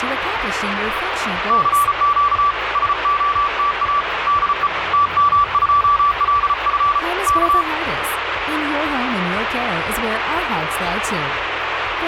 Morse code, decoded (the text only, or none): CQ SOTA DE TM2LF K